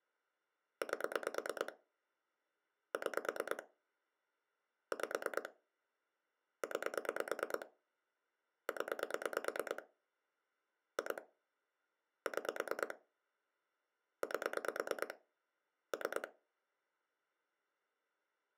Pulse dialling, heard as clicks on a phone line, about 9 pulses a second. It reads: 8 6 5 9 0 2 6 8 3